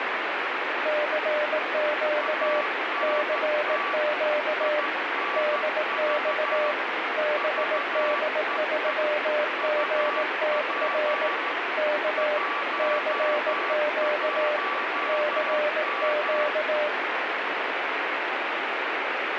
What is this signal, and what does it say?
Morse code, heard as two keyed tones, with heavy radio static. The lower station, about 18 wpm, 600 Hz: CQ CQ DX BD3GTR K CQ CQ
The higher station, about 13 wpm, 1150 Hz: ANT INV VEE UP 11M